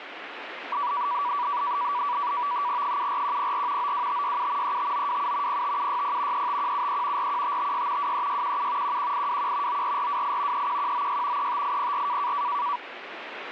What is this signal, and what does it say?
NAVTEX (SITOR-B), 100 baud, 170 Hz shift, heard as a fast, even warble, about 1060 Hz centre, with radio static. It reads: 74104 92567 35927 05760 35173 41556 23617 11821 94428 31196 35804